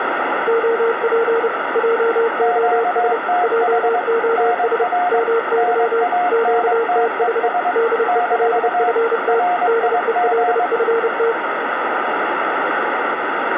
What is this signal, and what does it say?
Morse code, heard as two keyed tones, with radio static and a narrow filter. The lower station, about 30 wpm, 460 Hz: OP JOS JOS MY QTH DELFT DELFT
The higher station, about 22 wpm, 720 Hz: QTH NR NANTES - RIG